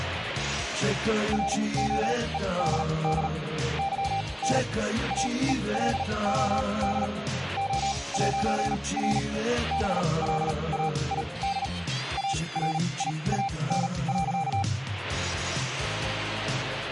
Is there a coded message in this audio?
Yes: Morse code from 1.3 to 14.7 s, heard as a keyed tone, machine-sent, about 38 wpm, spaced as for 25 wpm, 790 Hz. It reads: ROEDD YN AELOD O'R BLAID ARIAN.